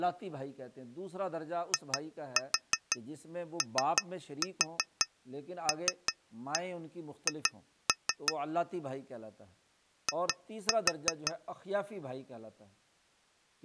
Tap code, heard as taps on glass, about 5 knocks a second, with speech in Urdu. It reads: IOLH I